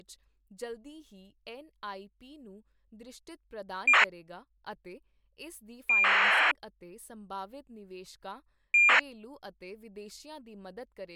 ACARS aircraft data, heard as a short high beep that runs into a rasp, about 2400 baud, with speech in Punjabi.